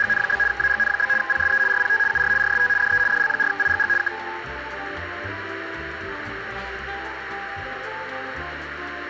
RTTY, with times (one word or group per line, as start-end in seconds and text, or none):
0.0-0.4 …
0.5-1.1 AGN?
1.2-1.6 PSE
1.7-2.0 RPT
2.1-2.3 UR
2.4-2.7 RST
2.8-3.0 DE
3.1-3.9 DL4IGG
4.0-4.1 K